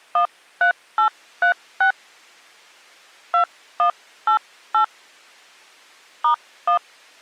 DTMF, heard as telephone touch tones, dialled by hand, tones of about 100 ms. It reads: 13836 2188 *1